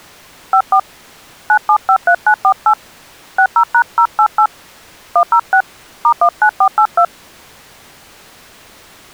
DTMF, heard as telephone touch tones, dialled by hand, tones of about 80 ms. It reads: 54 9753948 60#088 106 *19482